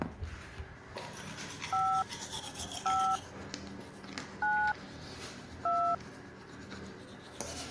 DTMF, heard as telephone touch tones, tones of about 300 ms, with the noise of a restroom. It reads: 5 5 9 2